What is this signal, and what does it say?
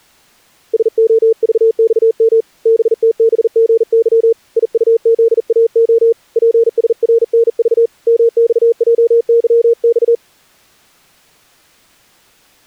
Morse code, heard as a keyed tone, hand-sent with a bug key, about 40 wpm, 460 Hz. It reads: SOVXM BTBGY IUZAO PSRNV MXJYX